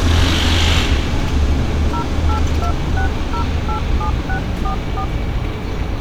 DTMF, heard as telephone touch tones, dialled by hand, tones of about 90 ms, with street noise. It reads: 0826087644